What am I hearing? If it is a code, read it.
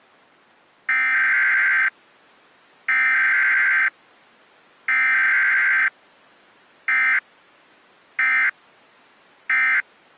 Emergency Alert System (SAME) tones (header bursts, then end-of-message bursts), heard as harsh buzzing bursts, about 520.83 baud.